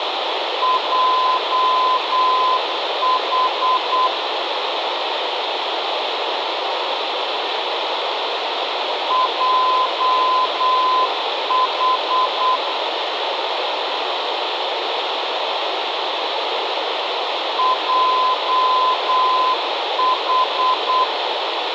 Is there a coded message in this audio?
Yes: Morse code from 0.6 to 21.1 s, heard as a keyed tone, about 8 wpm, 1020 Hz, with radio hiss and room echo. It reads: JH JH JH